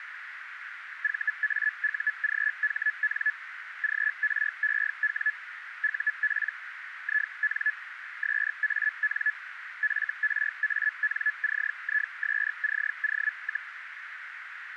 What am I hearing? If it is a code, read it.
Hellschreiber (Feld-Hell, 122.5 baud), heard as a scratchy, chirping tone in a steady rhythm, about 1700 Hz, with radio static and a narrow filter. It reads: VAUGHN GREW UP IN SAN FRANCISCO,